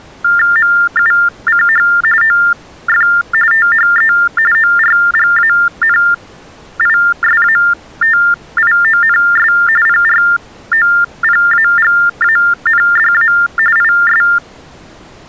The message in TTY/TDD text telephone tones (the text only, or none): MUCH OF THE ORGANISATIONS PROPAGANDA IS